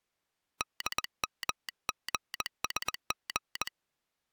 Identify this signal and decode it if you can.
Morse code, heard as a telegraph sounder, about 20 wpm. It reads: DMGSG